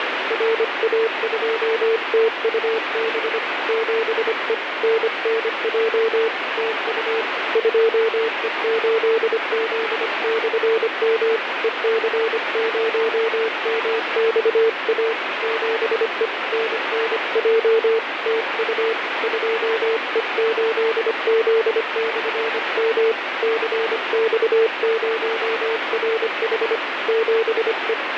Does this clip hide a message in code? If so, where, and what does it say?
Yes: Morse code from 0.2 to 28.0 s, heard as a keyed tone, hand-sent with a paddle, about 25 wpm, 450 Hz, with heavy radio static. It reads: RA2TUB 7E NNJ TU 2E8Z/M EC0MXA 7E NNJ TU 2E8Z/M CX0RH 7E